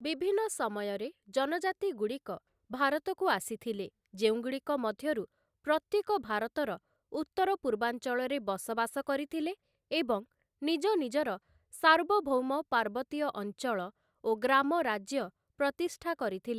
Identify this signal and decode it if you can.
Speech in Odia. There is no code.